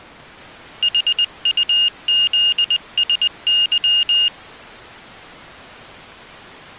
Morse code, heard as a high beeper, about 20 wpm, 2850 Hz. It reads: HUZSY